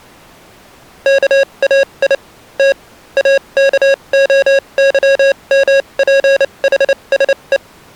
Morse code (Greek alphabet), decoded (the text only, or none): ΚΑΙ Τ ΑΚΟΥΜΠΗΣΕ